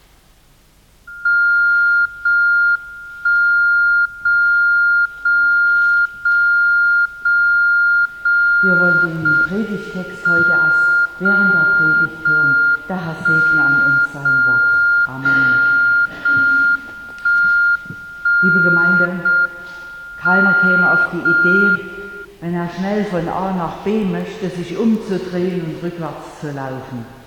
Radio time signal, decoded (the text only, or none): 0 1 0 0 0 0 0 0 M 0 0 1 0 0 0 1 1 0 M 0 1